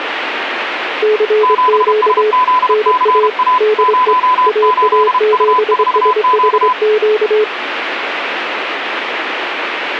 Morse code, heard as two keyed tones, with radio static. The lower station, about 24 wpm, 430 Hz: CQ NA DE AA7SHQ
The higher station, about 32 wpm, 1010 Hz: 7SZCA 08U4Q